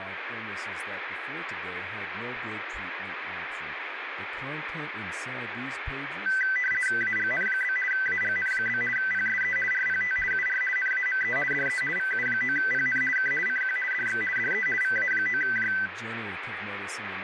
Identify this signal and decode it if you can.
RTTY (50 baud, 450 Hz shift), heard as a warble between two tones, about 1750 Hz centre, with radio static and speech in English. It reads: AGN? AGN? PSE RPT UR NAME DE VU9PN K CQ DX DE VA9J